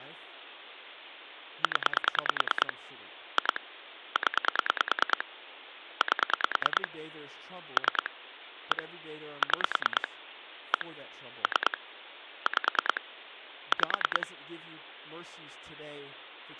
Pulse dialling, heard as clicks on a phone line, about 9 pulses a second, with phone line noise and speech in English. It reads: 0 2 0 8 3 1 6 1 3 5 5